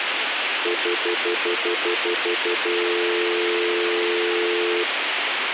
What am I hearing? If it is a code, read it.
Telephone call progress tone (North American plan), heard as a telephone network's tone, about 350, 440 Hz, 0.1 s on and 0.1 s off, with phone line noise. Stutter dial tone.